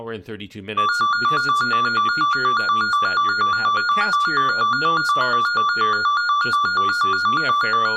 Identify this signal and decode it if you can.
A tone that alternates evenly between two pitches, with room echo and speech in English. There is no code.